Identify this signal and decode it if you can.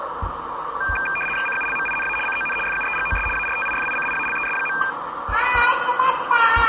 RTTY (75 baud, 850 Hz shift), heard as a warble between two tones, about 2000 Hz centre, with the noise of a park. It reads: CULMINA CON FUEGOS ARTIFICIALES.